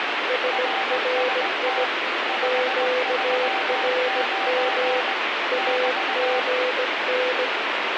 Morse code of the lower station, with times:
0.3-1.8 SRI
2.4-5.0 QRM
5.5-7.5 AGN

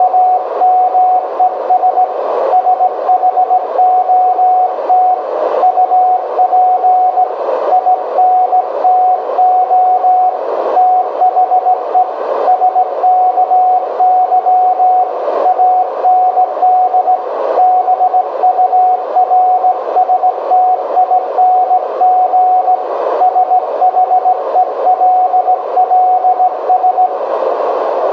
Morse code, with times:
0.0-2.0 …
2.5-5.1 SHOT
5.6-7.2 UP
7.7-10.3 INTO
10.8-12.0 THE
12.5-15.0 SKY
15.5-17.2 AND
17.6-22.7 BURSTING
23.2-27.1 SHELLS

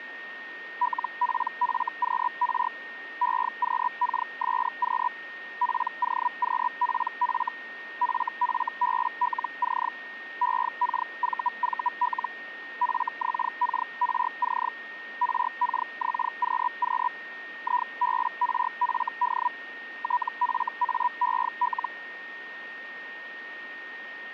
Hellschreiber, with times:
0.8-2.7 LPFQR
3.2-5.1 EQKSQ
5.6-7.5 POQPF
8.0-9.9 FFBLC
10.4-12.3 EKVVL
12.8-14.7 FXKRC
15.2-17.1 RKXQQ
17.6-19.5 IBRFD
20.0-21.9 TFAEL

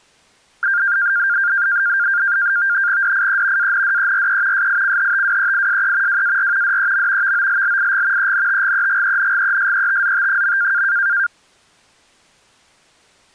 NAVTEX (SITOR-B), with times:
3.0-3.7 DIE
3.6-4.7 ANDERE
4.5-6.2 SICHTWEISE
6.1-6.8 WAR
6.6-7.3 DEM
7.2-8.3 VOLLIG
8.2-10.8 ENTGEGENGESETZT.

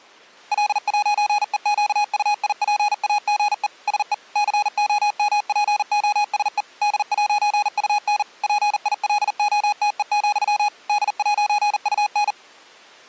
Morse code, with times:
0.5-3.7 L'EQUIPAGE
3.9-4.1 SE
4.4-6.6 COMPOSE
6.8-8.2 D'UN
8.4-10.7 PILOTE,
10.9-12.3 D'UN

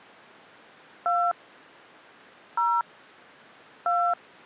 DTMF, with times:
1.1-1.3 2
2.6-2.8 0
3.9-4.1 2

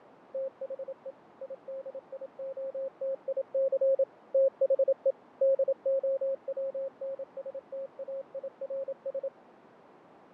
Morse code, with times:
0.3-1.1 THE
1.4-4.0 IDIOTIC
4.3-5.1 THE
5.4-9.3 DOWNSTAIRS

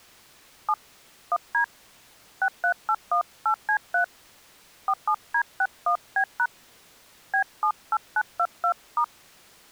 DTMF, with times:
0.7-0.7 7
1.3-1.6 1D
2.4-4.0 63818C3
4.9-6.5 47D61B#
7.3-9.0 B78922*

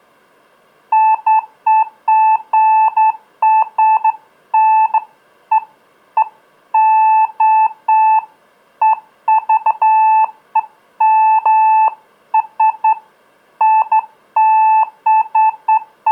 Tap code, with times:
none

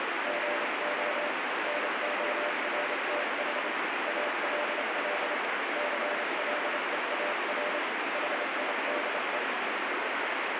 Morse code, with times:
0.3-1.3 GO
1.7-3.7 NORTH
4.1-5.3 ALL
5.8-7.8 CLEAR
8.1-9.4 HIDE

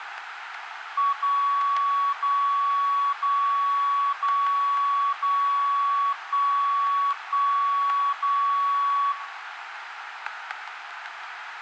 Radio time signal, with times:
1.1-2.1 0
2.1-3.1 0
3.1-4.1 0
4.1-5.1 0
5.1-6.1 0
6.1-7.1 1
7.1-8.1 1
8.1-9.1 0

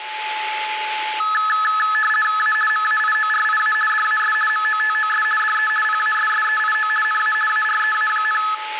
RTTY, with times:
2.4-2.5 A
2.7-3.7 MAIORIA
3.9-4.3 DAS
4.5-5.2 MOTOS
5.4-5.7 DE
5.8-6.9 PASSEIO
7.0-7.3 NA
7.5-8.4 AREA,

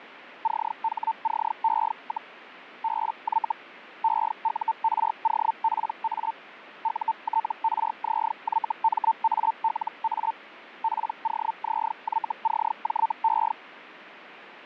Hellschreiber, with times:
0.4-2.3 CHCE,
2.8-3.5 BY
4.0-6.3 EUROPA
6.8-10.3 UTRZYMALA
10.8-13.5 POZYCJE

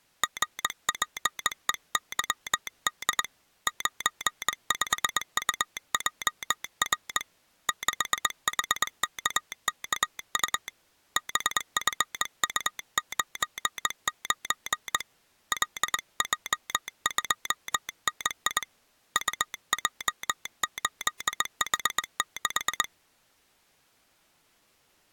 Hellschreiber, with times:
none

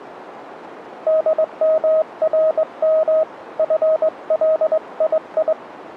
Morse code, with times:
1.1-3.2 DMRM
3.6-5.5 FLII

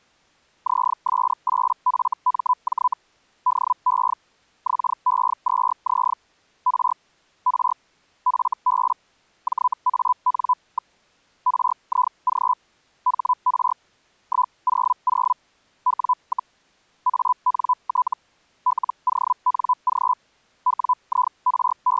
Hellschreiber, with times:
0.7-2.9 ZS8FMJ
3.5-4.1 DE
4.7-6.1 XE2Z
6.7-6.9 R
7.5-7.7 R
8.3-8.9 FB
9.5-10.9 JAN.
11.5-12.5 RIG
13.1-13.7 HR
14.3-15.3 100
15.9-16.5 W,
17.1-18.1 ANT
18.7-20.1 LONG
20.7-22.0 …

